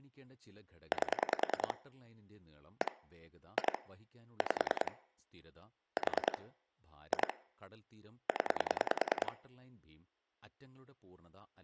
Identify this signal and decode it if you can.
Pulse dialling, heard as clicks on a phone line, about 10 pulses a second, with speech in Malayalam. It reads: 8 1 2 5 4 2 0